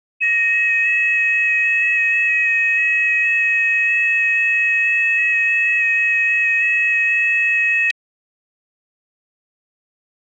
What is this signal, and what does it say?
FT8 (several signals at once), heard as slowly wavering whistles, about 6.25 baud.